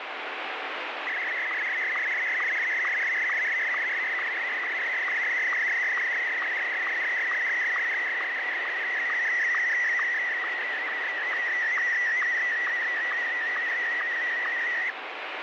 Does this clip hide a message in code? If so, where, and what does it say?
Yes: SSTV (slow-scan television), Martin M1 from 1.1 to 14.9 s, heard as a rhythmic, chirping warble, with heavy radio static.